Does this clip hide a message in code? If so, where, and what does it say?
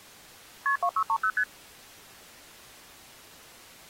Yes: multi-frequency trunk signalling (R1, as on North American trunks) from 0.7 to 1.4 s, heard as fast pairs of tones, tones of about 70 ms. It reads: KP 2630 ST